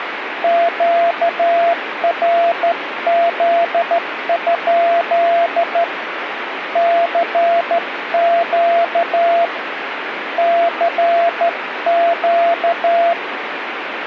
Morse code, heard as a keyed tone, hand-sent with a straight key, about 13 wpm, 680 Hz, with radio static. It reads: QRZ? CQ CQ